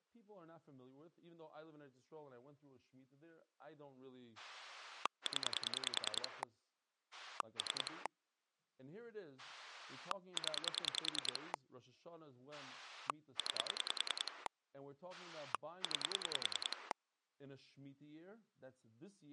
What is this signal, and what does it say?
Pulse dialling, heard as a rotary dial, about 10 pulses a second, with speech in English. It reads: 0 3 0 9 9